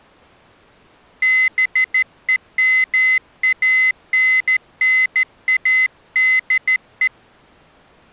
Morse code, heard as a high beeper, hand-sent with a straight key, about 14 wpm, 2050 Hz. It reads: BEMANNADE